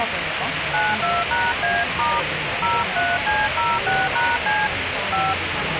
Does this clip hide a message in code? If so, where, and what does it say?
Yes: DTMF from 0.7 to 5.3 s, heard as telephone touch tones, dialled by hand, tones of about 210 ms, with radio hiss and the noise of a restaurant. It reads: 92#A* 03C06#C 5